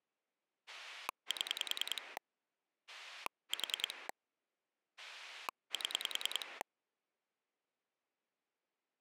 Pulse dialling, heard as a rotary dial, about 10 pulses a second. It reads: 7 4 7